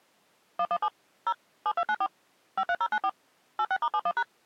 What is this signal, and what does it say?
DTMF, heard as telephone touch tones, dialled by machine, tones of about 60 ms. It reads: 117 0 7294 53094 86*71#